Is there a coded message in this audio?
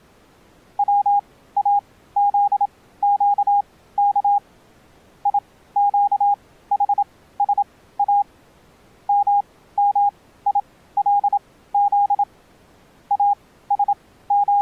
Yes: Morse code (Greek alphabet) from 0.7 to 14.6 s, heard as a keyed tone, machine-sent, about 27 wpm, spaced as for 16 wpm, 810 Hz. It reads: ΩΑΖΨΚ ΙΨΗΣΑ ΜΜΙΛΖ …